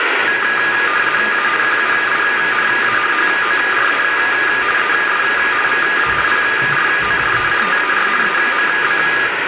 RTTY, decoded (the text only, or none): A QUINA HORA ES VA PROJECTAR AMB